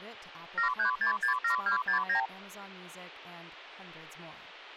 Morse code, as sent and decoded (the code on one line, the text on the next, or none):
none